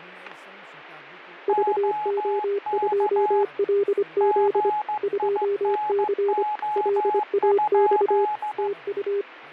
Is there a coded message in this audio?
Yes: Morse code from 1.4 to 9.3 s, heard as two keyed tones, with fading and speech in Nepali. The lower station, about 25 wpm, 400 Hz: VO2LZ 2C LAX TU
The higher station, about 15 wpm, 840 Hz: OK GINO?